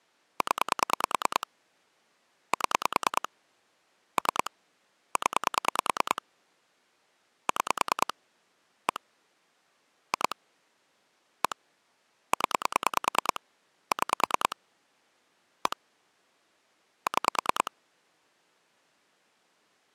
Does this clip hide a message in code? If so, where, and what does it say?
Yes: pulse dialling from 0.4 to 17.7 s, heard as clicks on a phone line, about 9 pulses a second. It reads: 0 7 3 0 6 1 2 1 0 6 1 6